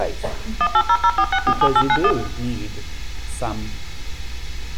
DTMF, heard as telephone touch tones, dialled by machine, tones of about 60 ms, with room echo. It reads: 18004647891